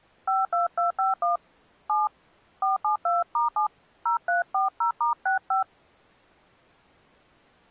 DTMF, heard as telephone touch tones, dialled by hand, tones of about 140 ms. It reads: 52251 7 472*7 0340*65